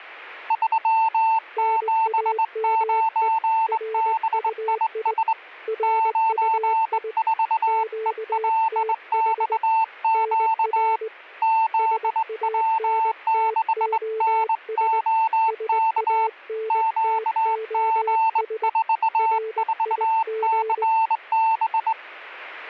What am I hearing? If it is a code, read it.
Morse code, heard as two keyed tones. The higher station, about 21 wpm, 890 Hz: 379BIS 94ELXQ ZW6NOK QG44CB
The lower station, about 20 wpm, 440 Hz: NAME RUI RUI QTH NR SANTOS SANTOS RIG